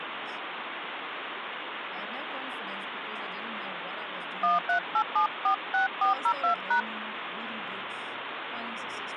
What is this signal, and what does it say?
DTMF, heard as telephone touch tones, dialled by hand, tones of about 120 ms, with phone line noise and speech in English. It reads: 138746402#